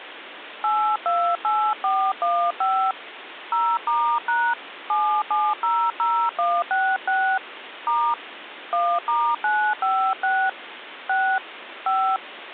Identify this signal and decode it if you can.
DTMF, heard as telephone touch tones, dialled by hand, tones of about 280 ms, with phone line noise. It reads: 828415 0*# 7700166 * 1*956 6 5